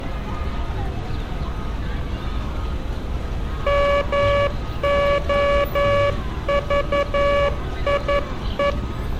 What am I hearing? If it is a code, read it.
Morse code, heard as a buzzer, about 11 wpm, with street noise. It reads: MOVIE